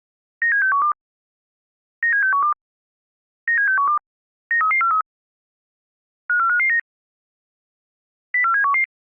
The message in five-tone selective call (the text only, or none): 97612 97612 97612 93343 54559 04711